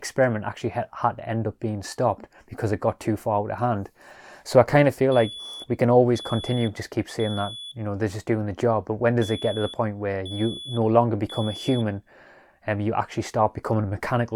Alarm pattern, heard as an alarm's beeps, played twice, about 3400 Hz, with room echo and speech in English. Temporal three. Smoke or fire, evacuate.